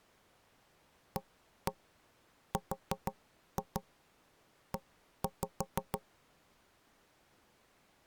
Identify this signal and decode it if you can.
Tap code, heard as knocks on wood, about 6 knocks a second. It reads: ARE